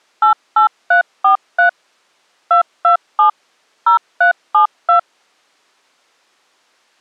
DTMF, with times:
0.2-1.7 88343
2.5-3.3 227
3.9-5.0 0372

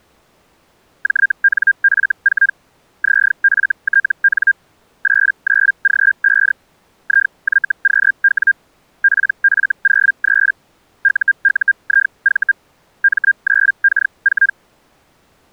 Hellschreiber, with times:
1.0-2.5 JNF4
3.0-4.5 ZFTN
5.0-6.5 89G5
7.0-8.5 IYQW
9.0-10.5 PF03
11.0-12.5 UUIV
13.0-14.5 M9K4

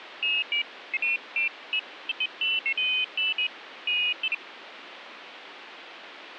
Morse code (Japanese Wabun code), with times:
none

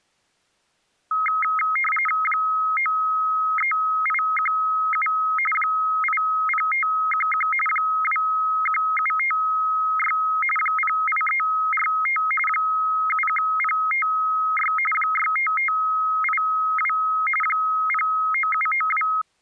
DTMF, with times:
none

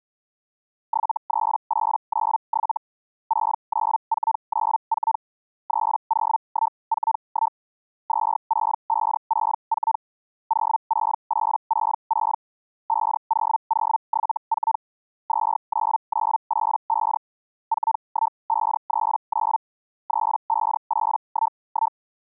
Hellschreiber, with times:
0.9-2.8 73897
3.3-5.2 69494
5.7-7.6 30141
8.1-10.0 26564
10.5-12.4 06866
12.9-14.8 50074
15.3-17.2 29985
17.7-19.6 41539
20.1-22.0 35811

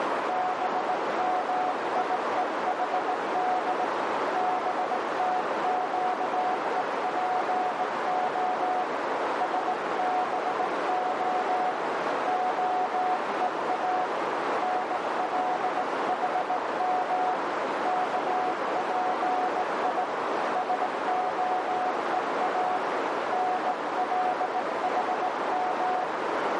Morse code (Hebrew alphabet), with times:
0.3-3.8 במיוחד
4.4-8.8 בתקופה
9.4-11.7 שבה
12.3-14.0 הוא
14.6-17.3 נלחם
17.9-20.0 כפי
20.6-22.8 שהוא
23.3-26.0 נלחם

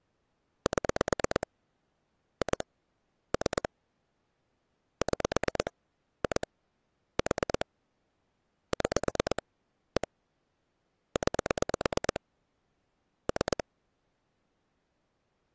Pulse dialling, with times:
0.7-1.5 7
2.4-2.6 2
3.3-3.7 3
5.0-5.7 6
6.2-6.5 2
7.2-7.7 4
8.7-9.4 6
10.0-10.1 1
11.2-12.2 9
13.3-13.6 3

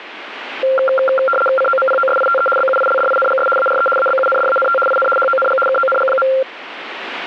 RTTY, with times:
1.6-2.5 COMPOSITE
2.6-3.5 BUILDINGS
3.6-3.9 ARE
4.0-4.8 ABUNDANT
4.9-5.1 IN
5.2-5.6 HONG
5.7-6.3 KONG.

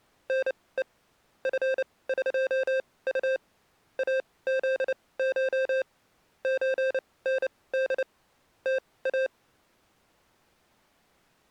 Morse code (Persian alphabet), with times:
0.3-0.8 نه
1.5-3.4 فقط
4.0-5.8 ازش
6.4-8.0 چند
8.7-9.3 تا

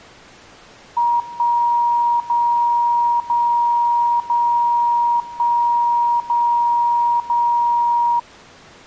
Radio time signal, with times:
1.2-2.2 1
2.2-3.2 0
3.2-4.2 0
4.2-5.2 0
5.2-6.2 1
6.2-7.2 0
7.2-8.2 0

